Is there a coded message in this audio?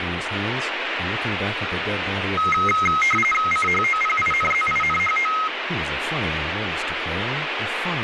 Yes: RTTY (45.45 baud, 850 Hz shift) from 2.4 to 5.5 s, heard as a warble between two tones, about 1700 Hz centre, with radio static and speech in English. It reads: CHOPINZINHO